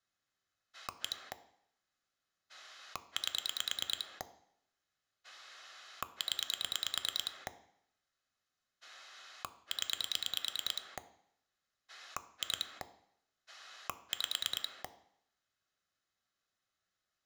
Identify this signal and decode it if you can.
Pulse dialling, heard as a rotary dial, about 9 pulses a second, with room echo. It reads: 1 8 0 0 2 5